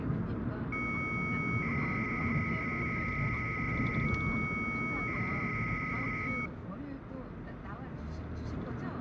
300-baud modem data (Bell 103 tones), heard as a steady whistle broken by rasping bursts, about 300 baud, 200 Hz shift, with hum and the noise inside a car.